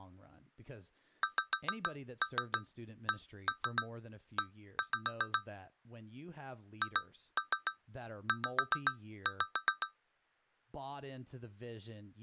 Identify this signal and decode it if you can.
Tap code, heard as taps on a metal pipe, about 7 knocks a second, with speech in English. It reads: XCE HZ